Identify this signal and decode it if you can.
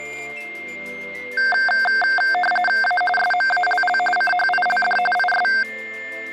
RTTY (45.45 baud, 850 Hz shift), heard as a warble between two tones, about 1140 Hz centre, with static crashes and a steady whistle near 2110 Hz. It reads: A SMALL CHILD IS